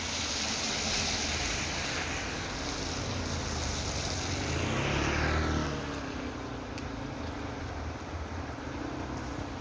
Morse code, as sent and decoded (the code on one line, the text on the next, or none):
none